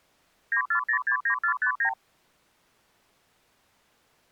Multi-frequency trunk signalling (R2, with the far end's replies), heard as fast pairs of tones, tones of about 90 ms. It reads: 94069459